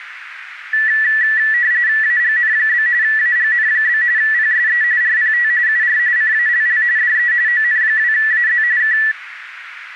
RTTY (45.45 baud, 170 Hz shift), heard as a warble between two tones, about 1850 Hz centre, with radio static. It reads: AGN? AGN? PSE RPT UR CALL DE ON2AZ K